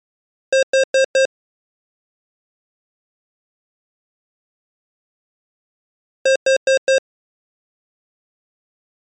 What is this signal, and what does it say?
Alarm pattern, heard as an alarm's beeps, played twice, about 530 Hz. Temporal four. Carbon monoxide.